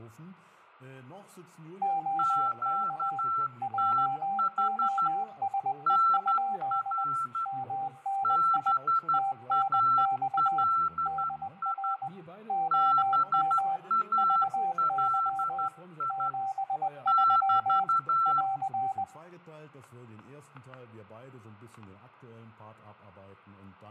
Morse code, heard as two keyed tones, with fading, static crashes and room echo. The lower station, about 20 wpm, 780 Hz: OK JOSE? MNI TNX DR OM VY 73 <AR>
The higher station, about 12 wpm, 1340 Hz: QTH NR BALI BALI <BT>